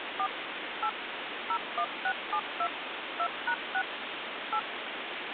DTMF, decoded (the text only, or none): 4 8 01672 2#6 8